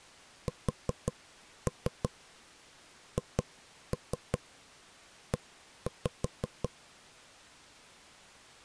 Tap code, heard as knocks on wood, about 5 knocks a second. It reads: SHE